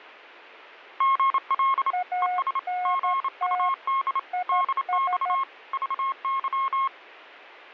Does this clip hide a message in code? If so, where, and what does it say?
Yes: Morse code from 0.9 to 6.9 s, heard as two keyed tones. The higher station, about 28 wpm, 1080 Hz: GL ES GUD DX VY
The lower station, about 13 wpm, 720 Hz: ANT IS